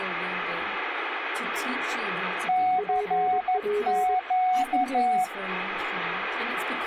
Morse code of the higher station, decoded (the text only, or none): CQ